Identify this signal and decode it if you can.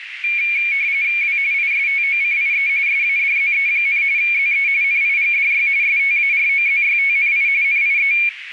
RTTY (45.45 baud, 170 Hz shift), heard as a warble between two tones, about 2300 Hz centre, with radio static and a narrow filter. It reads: W ISTOCIE SADZE, ZE NIGDY STAROZYTNI NIE